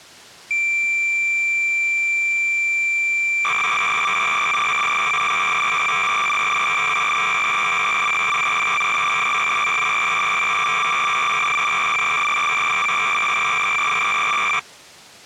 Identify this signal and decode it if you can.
Cassette data (Kansas City type), 300 baud, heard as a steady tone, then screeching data.